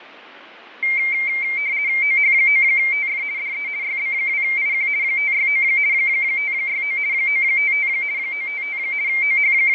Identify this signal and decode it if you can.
RTTY (50 baud, 170 Hz shift), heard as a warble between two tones, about 2200 Hz centre, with radio static and fading. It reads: OH9TF DE YB2IQ 569 569 955 955 …